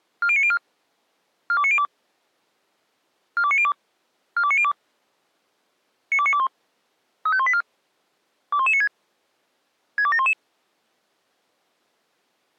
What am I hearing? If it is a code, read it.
Five-tone selective call (ZVEI), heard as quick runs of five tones, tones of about 70 ms. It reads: 40904 42902 42902 42902 92921 35184 21196 62711